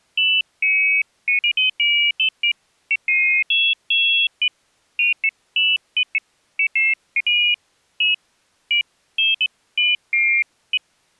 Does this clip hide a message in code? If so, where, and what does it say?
No, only pairs of high tones at irregular times.